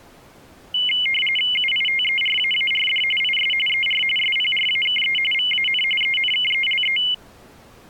RTTY (45.45 baud, 850 Hz shift), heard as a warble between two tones, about 2550 Hz centre. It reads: UITERAARD IS ER SPRAKE VAN ENKELE